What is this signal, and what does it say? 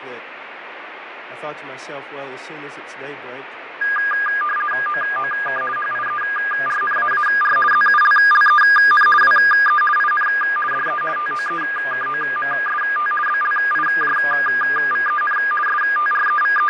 RTTY (50 baud, 450 Hz shift), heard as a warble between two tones, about 1420 Hz centre, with radio static and fading. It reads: OOK HIERNAAR ZULLEN WE IN DE TOEKOMST BLIJVEN …